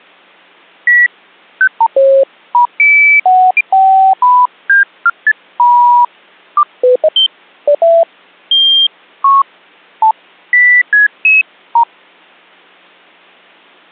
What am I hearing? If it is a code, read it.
Electronic bleeps of random pitch and length. There is no code.